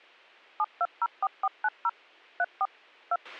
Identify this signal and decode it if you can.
DTMF, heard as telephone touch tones, dialled by machine, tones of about 50 ms, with a squelch burst at the end. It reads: 7204490 34 2